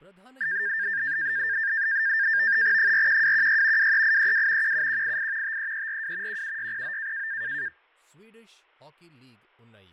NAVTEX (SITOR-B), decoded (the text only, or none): 41216 23832 17188 53342 17609